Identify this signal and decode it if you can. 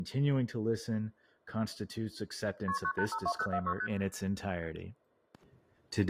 Multi-frequency trunk signalling (R1, as on North American trunks), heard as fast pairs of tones, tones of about 70 ms, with speech in English. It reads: KP 9852046 ST